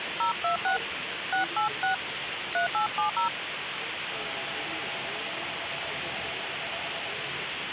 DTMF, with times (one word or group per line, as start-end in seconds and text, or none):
0.2-0.8 026
1.3-1.9 686
2.5-3.3 3870